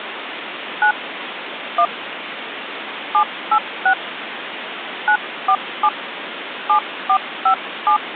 DTMF, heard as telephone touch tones, dialled by hand, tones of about 80 ms, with phone line noise. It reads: 9 1 786 947 7457